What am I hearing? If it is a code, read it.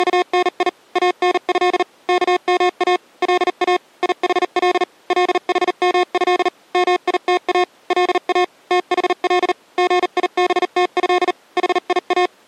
Morse code (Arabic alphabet), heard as electronic beeps, machine-sent, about 39 wpm, spaced as for 36 wpm, 360 Hz. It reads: … انه كما لا يحل لحمه ميتا لا تحل غيبته حيا